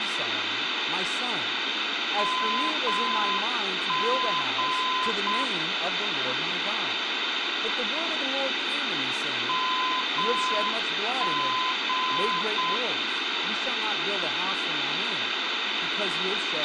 Morse code, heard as a keyed tone, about 7 wpm, 1020 Hz, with radio hiss, a squelch burst at the end, room echo and speech in English. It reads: MG MG